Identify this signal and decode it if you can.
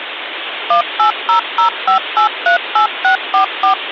DTMF, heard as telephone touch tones, dialled by machine, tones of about 110 ms, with phone line noise. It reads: 18005838644